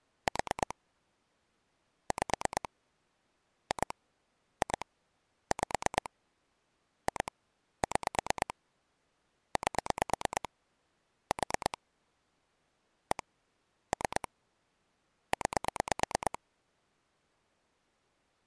Pulse dialling, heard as clicks on a phone line, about 9 pulses a second. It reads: 4 5 2 2 5 2 6 8 4 1 3 9